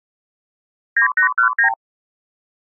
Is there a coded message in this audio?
Yes: multi-frequency trunk signalling (R2, with the far end's replies) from 1.0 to 1.7 s, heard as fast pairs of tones, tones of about 100 ms. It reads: 9819